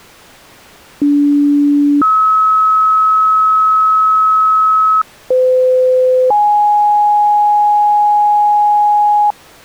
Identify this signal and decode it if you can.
Two-tone page, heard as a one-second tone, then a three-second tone, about 290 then 1290 Hz, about 510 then 830 Hz.